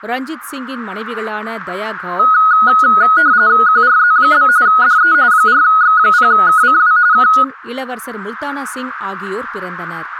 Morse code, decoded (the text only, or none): none